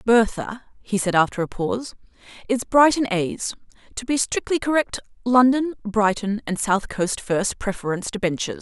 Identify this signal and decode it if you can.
Speech in English. There is no code.